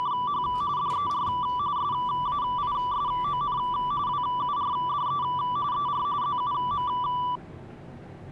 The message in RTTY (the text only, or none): … DER SAISON WURDE ER ZUM